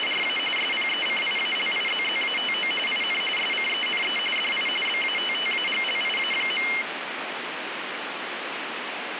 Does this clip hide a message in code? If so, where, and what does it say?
Yes: RTTY (45.45 baud, 850 Hz shift) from 0.0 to 6.8 s, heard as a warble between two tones, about 2550 Hz centre, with radio static. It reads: … SPECIALIZZATO IN SCENE DI BATTAGLIA.